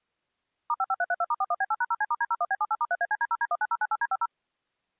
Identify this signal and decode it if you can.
DTMF, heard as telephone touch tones, dialled by machine, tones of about 40 ms. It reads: *55332*41B8#0C*D01B78*3ACD0D19098D50